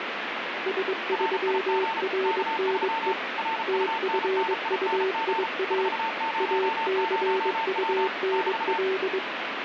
Morse code, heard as two keyed tones, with radio static. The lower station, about 22 wpm, 380 Hz: S3RNE TFUIA ACUNL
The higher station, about 34 wpm, 900 Hz: RIG K3 RUNNING 400W <BT>